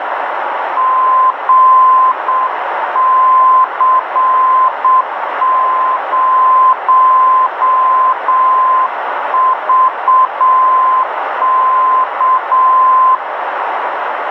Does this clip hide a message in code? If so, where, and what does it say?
Yes: Morse code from 0.7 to 13.2 s, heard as a keyed tone, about 7 wpm, 1030 Hz, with radio static and a narrow filter. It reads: GC0VK